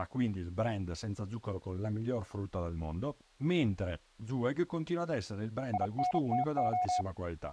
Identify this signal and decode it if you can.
Morse code, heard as a keyed tone, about 32 wpm, 730 Hz, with speech in Italian. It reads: INTO